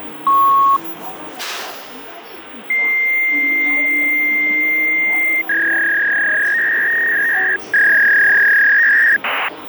Fax machine handshake, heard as a beep, a long tone and a warble, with phone line noise and the noise inside a bus.